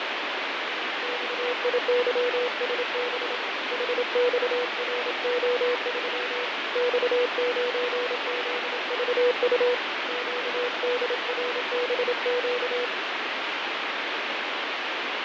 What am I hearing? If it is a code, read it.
Morse code, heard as a keyed tone, hand-sent with a paddle, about 27 wpm, 490 Hz, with heavy radio static and fading. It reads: XIYSB HXRO3 X9ZVU QDRBQ